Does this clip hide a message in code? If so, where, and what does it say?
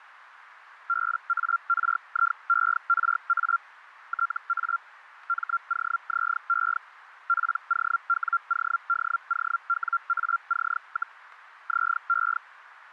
Yes: Hellschreiber (Feld-Hell, 122.5 baud) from 0.9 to 12.4 s, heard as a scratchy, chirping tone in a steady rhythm, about 1380 Hz, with radio static. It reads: BARIERA TA MOZE POWODOWAC, ZE